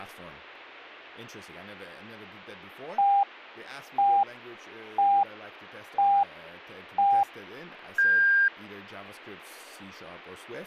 Radio time signal (five pips and a higher one, as on Chinese radio), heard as pips, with speech in English.